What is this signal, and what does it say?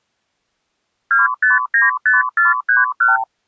Multi-frequency trunk signalling (R2, with the far end's replies), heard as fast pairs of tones, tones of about 160 ms. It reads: 2595431